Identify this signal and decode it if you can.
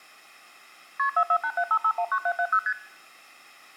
Multi-frequency trunk signalling (R1, as on North American trunks), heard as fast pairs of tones, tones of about 70 ms. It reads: KP 44875519770 ST